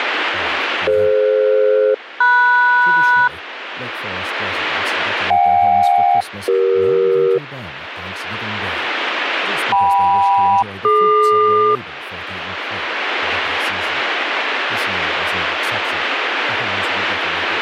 Aircraft SELCAL, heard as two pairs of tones, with radio static and speech in English. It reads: DF-MS JK-CE KM-DQ